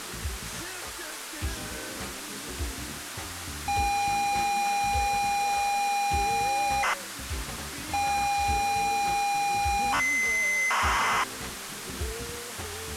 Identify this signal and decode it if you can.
ZX Spectrum tape loading, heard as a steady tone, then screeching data, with tape hiss.